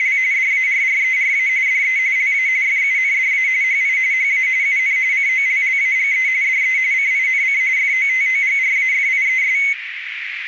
RTTY (45.45 baud, 170 Hz shift), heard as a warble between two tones, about 2150 Hz centre, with radio static and a narrow filter. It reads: … DARRERA DE LA FUNDA HI HA UN COLLAGE DE CINC FOTOGRAFIES